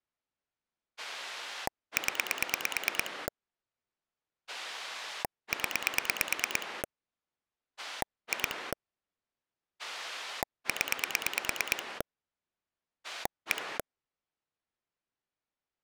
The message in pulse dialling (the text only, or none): 0 0 2 0 1